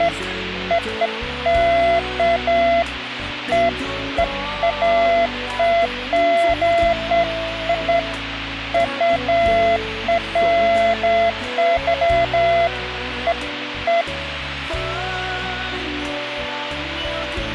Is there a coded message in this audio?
No, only beeps of irregular length, with radio hiss.